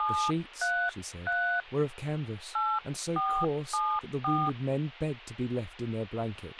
DTMF, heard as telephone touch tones, dialled by hand, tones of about 290 ms, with a squelch burst at the end and speech in English. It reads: 733 8474